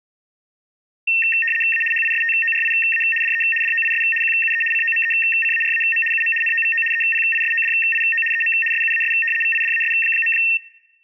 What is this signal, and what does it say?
RTTY (75 baud, 850 Hz shift), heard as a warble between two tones, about 2250 Hz centre. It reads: A HISTORIA DE DOIS QUE COMECARAM UM NOVO EPISODIO EM SUAS VIDAS.